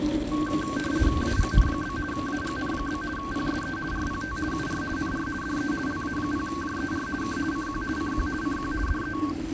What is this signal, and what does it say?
RTTY (50 baud, 450 Hz shift), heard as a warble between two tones, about 1330 Hz centre, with radio static and the noise of a residential street. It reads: AGN? AGN? PSE RPT UR NR DE LA0JER K CQ CQ CQ DE